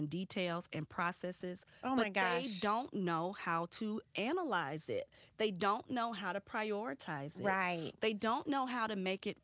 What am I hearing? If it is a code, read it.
Speech in English. There is no code.